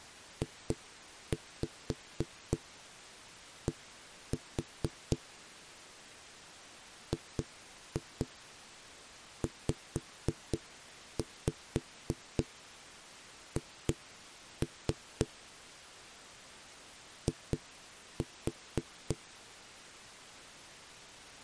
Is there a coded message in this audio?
Yes: tap code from 0.4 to 19.2 s, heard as knocks on a wall, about 3 knocks a second. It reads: JD GZH I